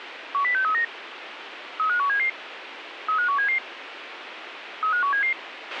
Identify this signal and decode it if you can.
Five-tone selective call (CCIR), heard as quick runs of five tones, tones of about 100 ms, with radio hiss and a squelch burst at the end. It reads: 10639 35177 35177 35177